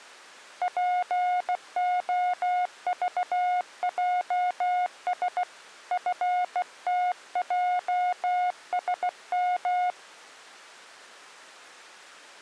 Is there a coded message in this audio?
Yes: Morse code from 0.6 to 10.0 s, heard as a keyed tone, hand-sent with a bug key, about 16 wpm, 720 Hz. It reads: POVJS FTJSM